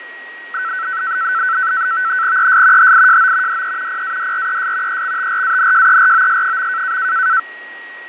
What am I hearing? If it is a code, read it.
NAVTEX (SITOR-B), 100 baud, 170 Hz shift, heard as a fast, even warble, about 1420 Hz centre, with radio static, fading and a steady whistle near 1900 Hz. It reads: ES HIJO DE PADRES EXTRANJEROS.